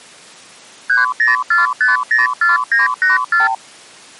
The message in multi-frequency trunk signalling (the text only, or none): 304504984